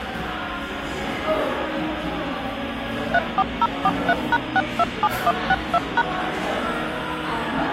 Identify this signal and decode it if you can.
DTMF, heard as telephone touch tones, dialled by machine, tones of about 40 ms, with the noise of a crowd indoors. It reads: 34043#627162#